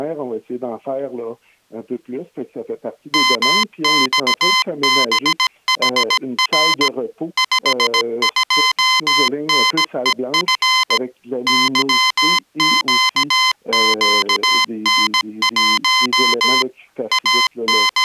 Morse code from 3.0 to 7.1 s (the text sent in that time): MXBHR